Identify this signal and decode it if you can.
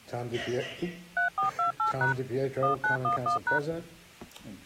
DTMF, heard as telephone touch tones, dialled by machine, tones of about 120 ms. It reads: 3428# 1911#